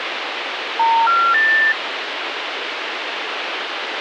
Telephone call progress tone (North American plan), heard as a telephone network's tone, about 910, 1370, 1800 Hz, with phone line noise. Special information tone.